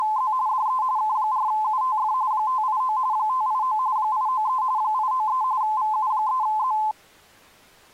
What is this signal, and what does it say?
RTTY (45.45 baud, 170 Hz shift), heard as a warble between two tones, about 950 Hz centre. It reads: … DE K4UTF 589 589 893 893 VU3Z